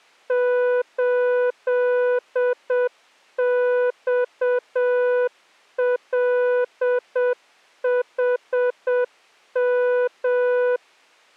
Morse code, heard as a keyed tone, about 7 wpm, 490 Hz. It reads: 8XLHM